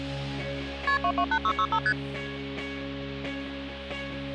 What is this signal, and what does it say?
Multi-frequency trunk signalling (R1, as on North American trunks), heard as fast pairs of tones, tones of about 70 ms. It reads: KP 228665 ST